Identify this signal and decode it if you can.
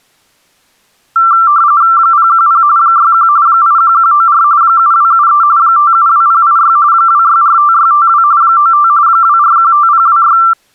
RTTY (45.45 baud, 170 Hz shift), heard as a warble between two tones, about 1260 Hz centre. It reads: 010 61 81194 7273 572086 2645652 95 2415026